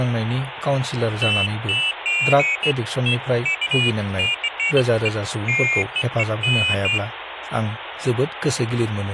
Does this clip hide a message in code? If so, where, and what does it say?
No, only pairs of high tones at irregular times, with phone line noise and speech in Bodo.